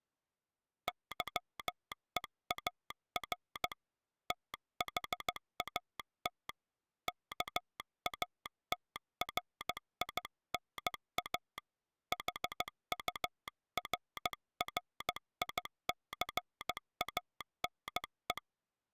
Morse code, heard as a telegraph sounder, hand-sent with a paddle, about 15 wpm. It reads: YEAR THAT KATRINA HURRICANE